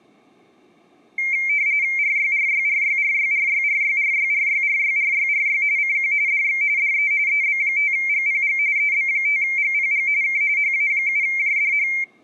RTTY (45.45 baud, 170 Hz shift), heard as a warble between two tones, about 2200 Hz centre. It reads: RYRYRYRYRYRYRYRYRYRYRY CQ DX DE EB5GPG EB5GPG K HA7JDH